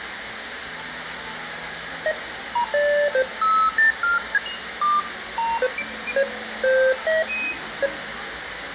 Electronic bleeps of random pitch and length, with radio hiss, room echo and the noise of a crowd indoors. There is no code.